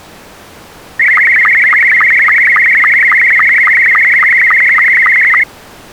SSTV (slow-scan television), Scottie S2, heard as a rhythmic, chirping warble.